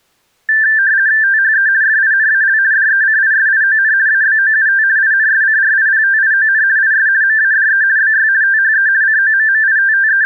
RTTY (50 baud, 170 Hz shift), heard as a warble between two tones, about 1650 Hz centre. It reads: THE FINAL DECISION ABOUT INSCRIPTION IS MADE BY THE …